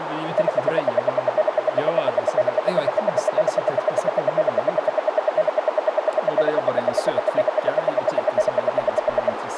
Radio time signal (RWM, Moscow), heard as ten pulses a second, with radio static, a narrow filter and speech in Swedish.